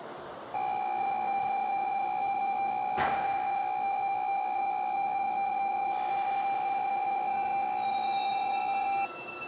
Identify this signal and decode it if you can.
PSK63 (62.5 baud), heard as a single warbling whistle, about 790 Hz, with the noise of a subway station.